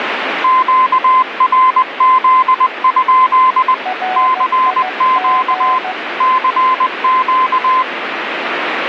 Morse code, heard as two keyed tones, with radio static. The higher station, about 20 wpm, 1030 Hz: QRZ? CQ CQ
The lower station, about 15 wpm, 740 Hz: RIG